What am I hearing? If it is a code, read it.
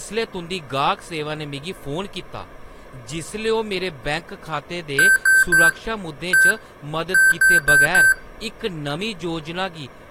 Beep code, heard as beeps from a small speaker, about 1550 Hz, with speech in Dogri. 3-1-4. In Phoenix BIOS tables: interrupt mask register failure.